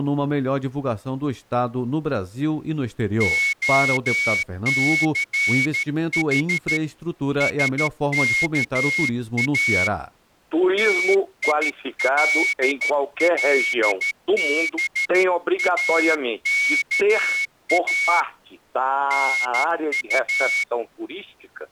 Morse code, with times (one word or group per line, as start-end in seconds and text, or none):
3.2-6.8 OCH
7.4-9.9 SKA
10.8-18.2 TILLBAKA
19.1-20.6 NU